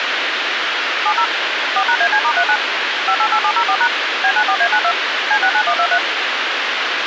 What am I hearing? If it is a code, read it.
DTMF, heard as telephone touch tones, dialled by machine, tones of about 70 ms, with radio hiss. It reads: 70 4#AC*39 588704# B94A92 C69123